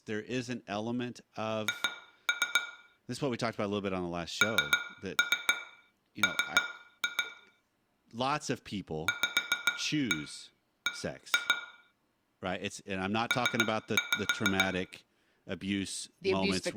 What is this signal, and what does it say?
Tap code, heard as taps on glass, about 7 knocks a second, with room echo and speech in English. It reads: H NM VB P